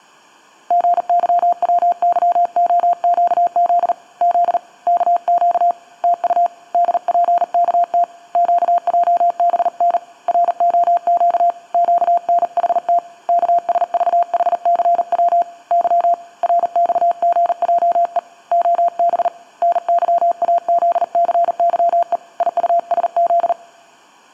Morse code, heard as a keyed tone, hand-sent with a paddle, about 39 wpm, 690 Hz. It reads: GYWYOQZ Z KQ TU DPKT QJBN ROQ QNHT KSVHCW Y RXGJE OB NYAZCYE IUSZ